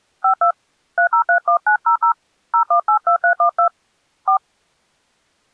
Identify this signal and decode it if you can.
DTMF, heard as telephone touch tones, dialled by hand, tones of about 100 ms. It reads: 52 3031900 0182312 4